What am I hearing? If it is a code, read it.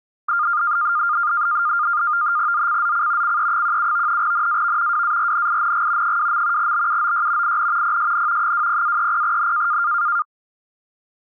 NAVTEX (SITOR-B), 100 baud, 170 Hz shift, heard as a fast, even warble, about 1310 Hz centre. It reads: ZCZC CE17 NAV WARNING 2. BUOY IN PSN 20-30N